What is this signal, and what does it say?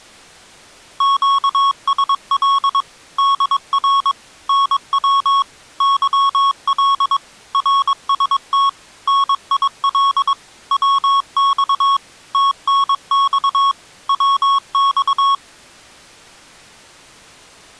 Morse code, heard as electronic beeps, machine-sent, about 22 wpm, 1100 Hz. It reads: QSL DR NW YL RST NIL WX TNX WX